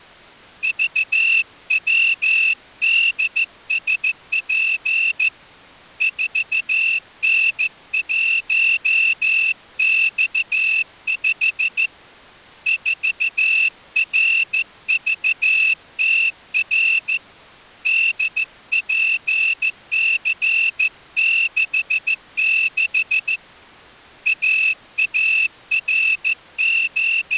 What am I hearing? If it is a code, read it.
Morse code, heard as a whistle, hand-sent with a straight key, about 14 wpm. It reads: VWDSP 4N1X5 4RVTR DPC66 …